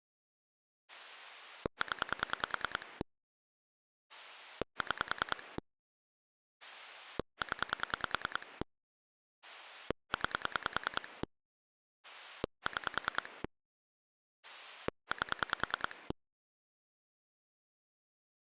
Pulse dialling, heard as a rotary dial, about 10 pulses a second. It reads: 0 6 0 9 6 8